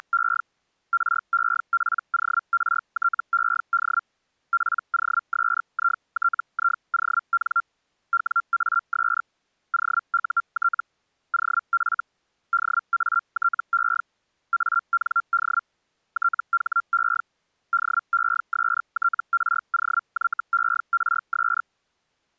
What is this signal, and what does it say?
Hellschreiber (Feld-Hell, 122.5 baud), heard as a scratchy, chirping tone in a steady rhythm, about 1380 Hz. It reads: … REPORTED POSITION WAS OUT OF DATE AND THE DESTROYERS